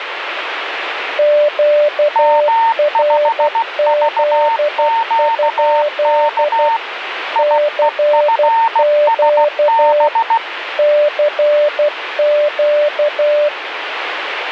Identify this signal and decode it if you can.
Morse code, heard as two keyed tones, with radio static. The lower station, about 12 wpm, 590 Hz: QRZ? CQ CQ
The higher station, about 16 wpm, 910 Hz: M5VQK IEFSB